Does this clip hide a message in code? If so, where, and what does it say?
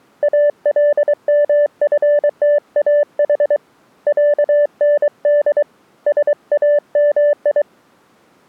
Yes: Morse code (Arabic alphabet) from 0.2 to 7.7 s, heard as a keyed tone, hand-sent with a paddle, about 23 wpm, 590 Hz. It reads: المفتاح عند سامي